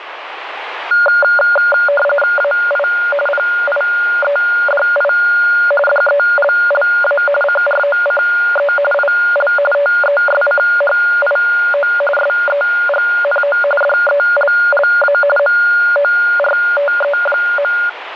RTTY (45.45 baud, 850 Hz shift), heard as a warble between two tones, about 1000 Hz centre, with radio static. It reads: AI PIEDI DELLA CROCE IL TESCHIO SEGNO DELLA MORTE.